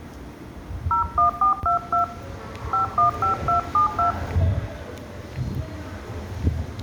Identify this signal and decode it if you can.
DTMF, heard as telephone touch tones, dialled by hand, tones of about 120 ms, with room echo and the noise of a subway station. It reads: 01422 515272